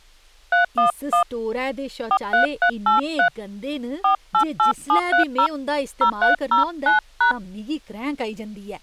DTMF, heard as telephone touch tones, dialled by hand, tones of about 100 ms, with speech in Dogri. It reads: 311 43383 488730 0309#